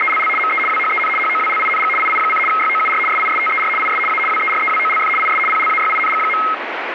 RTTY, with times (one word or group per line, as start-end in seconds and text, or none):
0.0-0.3 …
0.4-0.6 ME
0.7-1.1 WHEN
1.2-1.9 HOWLING
2.0-2.4 II:
2.5-3.0 YOUR
3.1-3.7 SISTER
3.8-4.0 IS
4.1-4.2 A
4.3-5.1 WEREWOLF
5.2-5.4 IS
5.5-6.4 PLAYING.